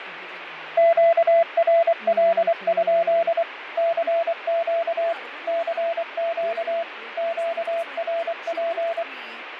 Morse code, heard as a keyed tone, machine-sent, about 24 wpm, 670 Hz, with radio static, fading and speech in English. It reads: QRL? CQ CQ QRP